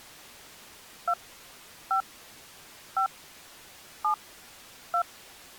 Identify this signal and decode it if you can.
DTMF, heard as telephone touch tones, dialled by hand, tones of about 80 ms. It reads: 2 5 5 7 2